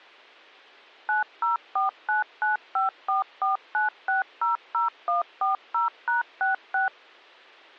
DTMF, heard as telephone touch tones, dialled by machine, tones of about 140 ms. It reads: 904995449600140#66